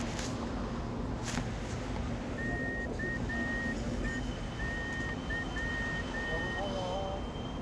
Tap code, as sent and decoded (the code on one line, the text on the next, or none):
none